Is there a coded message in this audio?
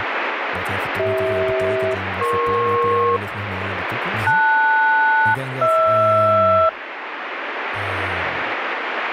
Yes: aircraft SELCAL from 1.0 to 6.7 s, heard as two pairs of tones, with radio static and speech in Dutch. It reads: CH-EP LS-HR